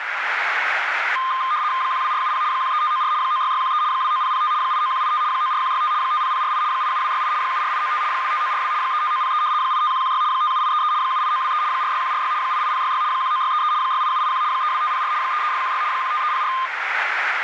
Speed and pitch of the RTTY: 75 baud, 170 Hz shift, 1130 Hz centre

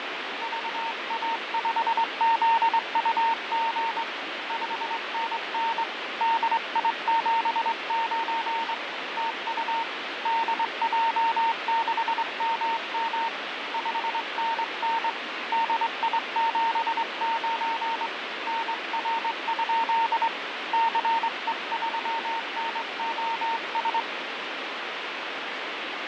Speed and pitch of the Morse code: 23 wpm, 910 Hz

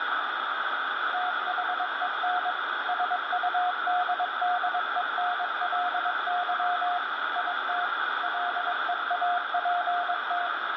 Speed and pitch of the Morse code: 22 wpm, 720 Hz

